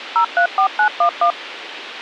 DTMF, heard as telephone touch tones, dialled by machine, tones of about 90 ms, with radio hiss and a squelch burst at the end. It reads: 034911